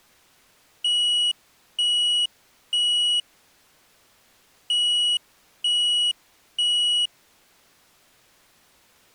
Alarm pattern, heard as an alarm's beeps, played twice, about 2900 Hz. Temporal three. Smoke or fire, evacuate.